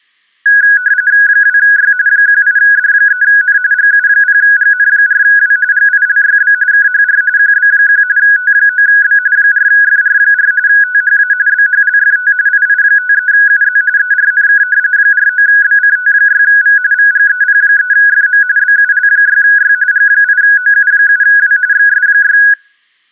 RTTY (45.45 baud, 170 Hz shift), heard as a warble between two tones, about 1550 Hz centre, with room echo. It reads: 2Y 18D3N GU0GN4W GILYB KHR QB1 T9B 4FR4 THA BHLFT II53UZ ERNK 49BCT6V VGEP3FM BUL6Y G8OU7W XS6